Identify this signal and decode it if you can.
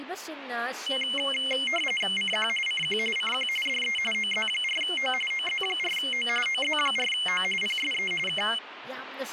RTTY (45.45 baud, 850 Hz shift), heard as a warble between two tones, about 2550 Hz centre, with radio static and speech in Manipuri. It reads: CQ CQ CQ DE OZ4O OZ4O OZ4O PSE K